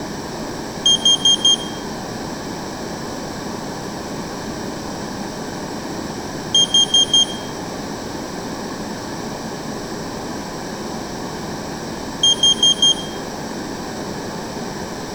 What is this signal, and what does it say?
Alarm pattern, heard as an alarm's beeps, played three times, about 3200 Hz, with room echo. Temporal four. Carbon monoxide.